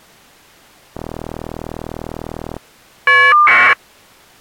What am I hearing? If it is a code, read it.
Caller ID data burst, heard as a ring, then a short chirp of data, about 1200 baud.